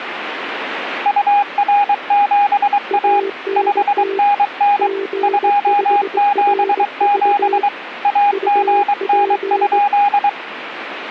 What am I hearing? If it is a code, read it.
Morse code, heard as two keyed tones, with radio static. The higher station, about 23 wpm, 820 Hz: UR7A 5NN 277 AGN?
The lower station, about 20 wpm, 390 Hz: ANT G5RV UP